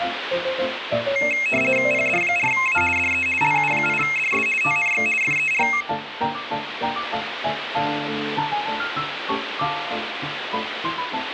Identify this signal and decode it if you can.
RTTY (50 baud, 450 Hz shift), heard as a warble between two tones, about 2350 Hz centre, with radio static. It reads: PD4A DE LU8DS TNX FER